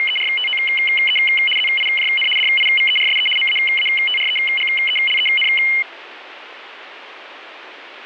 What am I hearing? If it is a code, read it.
RTTY (75 baud, 850 Hz shift), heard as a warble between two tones, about 2550 Hz centre, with radio static. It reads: … ZIJN DIVERSE MAATREGELEN